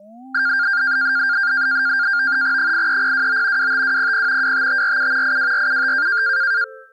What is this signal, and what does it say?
NAVTEX (SITOR-B), 100 baud, 170 Hz shift, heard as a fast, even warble, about 1500 Hz centre. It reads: 83029 25200 25547 82475